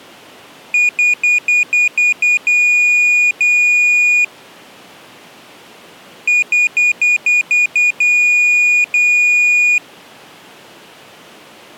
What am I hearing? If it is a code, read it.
Beep code, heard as a piezo beeper, played twice, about 2450 Hz. 7 short, 2 long.